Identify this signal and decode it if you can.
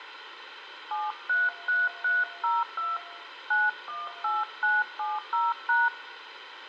DTMF, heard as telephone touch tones, dialled by hand, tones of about 190 ms, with radio hiss and room echo. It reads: 733302 918970#